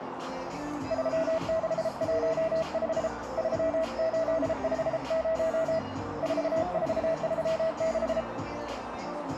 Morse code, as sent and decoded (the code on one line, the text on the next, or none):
...-- -.... .---- ..... / ...-- ---.. ..... ----- / ....- ....- ...-- -....
3615 3850 4436